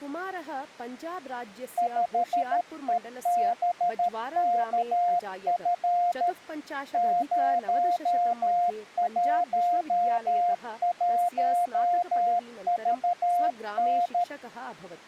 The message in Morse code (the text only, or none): 5EBKF 011VN